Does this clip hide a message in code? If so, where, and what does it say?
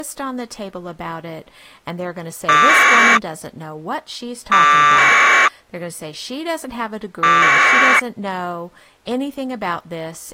Yes: packet radio (AX.25, as in APRS), 1200 baud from 2.5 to 8.0 s, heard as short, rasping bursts, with speech in English.